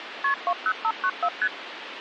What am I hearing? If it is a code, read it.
Multi-frequency trunk signalling (R1, as on North American trunks), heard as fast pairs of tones, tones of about 60 ms, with phone line noise. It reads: KP 20594 ST